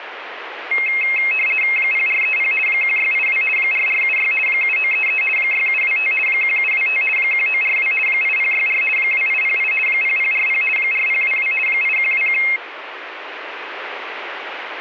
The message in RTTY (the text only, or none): 0430 1682 4476 7933 6725 1725 1942 8064 2808 0040 4022 8121